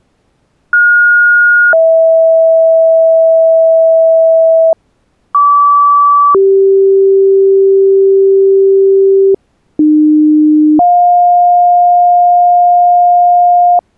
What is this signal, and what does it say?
Two-tone page, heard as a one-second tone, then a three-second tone, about 1430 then 650 Hz, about 1150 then 390 Hz, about 300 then 710 Hz.